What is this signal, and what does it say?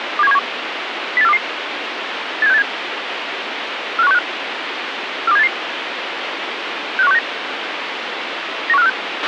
Five-tone selective call (EEA), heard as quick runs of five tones, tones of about 40 ms, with radio hiss and a squelch burst at the end. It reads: 27171 08422 87687 45165 42788 65169 91546